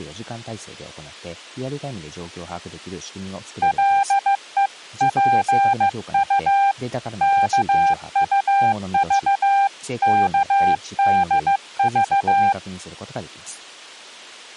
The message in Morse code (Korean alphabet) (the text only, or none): 가지 일을